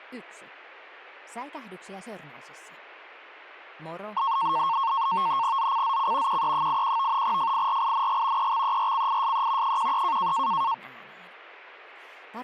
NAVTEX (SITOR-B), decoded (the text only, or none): ZCZC QE81 FIRING EXERCISE 13